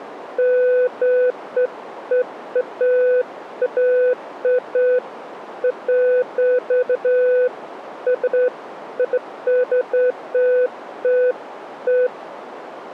Beeps of irregular length, with radio static. There is no code.